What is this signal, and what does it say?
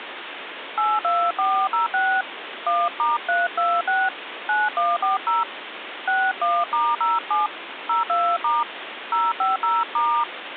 DTMF, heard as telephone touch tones, dialled by hand, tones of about 210 ms, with phone line noise. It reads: 82406 1*326 9140 61*07 02* 050*